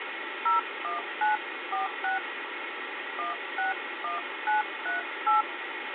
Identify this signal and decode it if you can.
DTMF, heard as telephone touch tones, dialled by hand, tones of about 140 ms, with phone line noise. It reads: 01946 161938